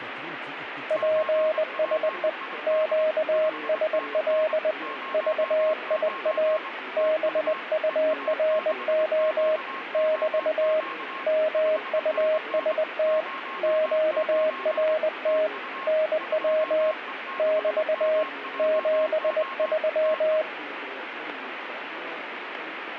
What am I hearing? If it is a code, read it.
Morse code, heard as a keyed tone, hand-sent with a bug key, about 20 wpm, 630 Hz, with radio static and a weaker station near 1080 Hz. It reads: PSE QSL VIA BURO <BT> MUST QRT NW <BT> 73